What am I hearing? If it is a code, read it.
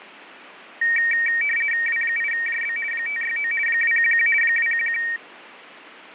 RTTY (50 baud, 450 Hz shift), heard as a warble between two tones, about 2100 Hz centre. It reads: W8JB 569 211 211